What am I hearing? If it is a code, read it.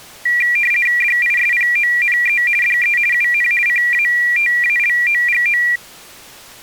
RTTY (50 baud, 450 Hz shift), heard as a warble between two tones, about 2150 Hz centre. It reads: DISPONE DE UN CATALOGO